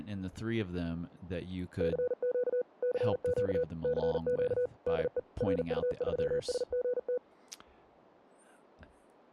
Morse code, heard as a keyed tone, machine-sent, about 40 wpm, 490 Hz, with speech in English. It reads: CQ CQ CQ DE RU3SGT